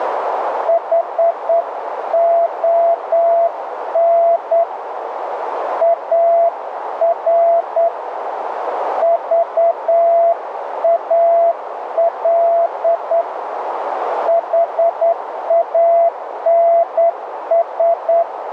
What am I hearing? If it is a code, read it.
Morse code, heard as a keyed tone, hand-sent with a straight key, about 9 wpm, 680 Hz, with radio static and a narrow filter. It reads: HON AR VAL HANS